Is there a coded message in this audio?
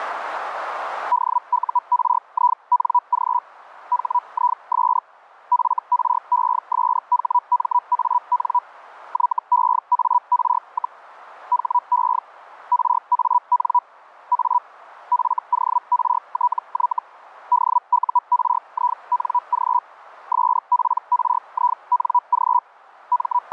Yes: Hellschreiber (Feld-Hell, 122.5 baud) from 1.1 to 23.5 s, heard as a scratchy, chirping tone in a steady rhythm, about 980 Hz, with radio static. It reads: DURING HIS FRESHMAN YEAR, HE RAN A FORTY DURING SPRING …